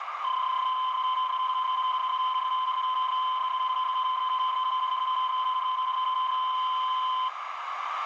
PSK31 (31.25 baud), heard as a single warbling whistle, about 1030 Hz, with radio static and a narrow filter.